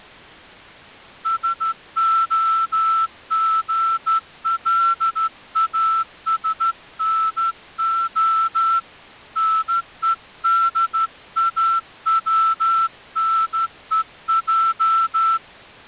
Morse code (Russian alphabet), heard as a whistle, hand-sent with a straight key, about 13 wpm. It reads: СОГЛАСНО НЕДАВНЕЙ